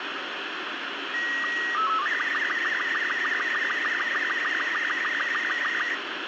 SSTV (slow-scan television), Robot 36, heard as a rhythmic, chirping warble, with radio static.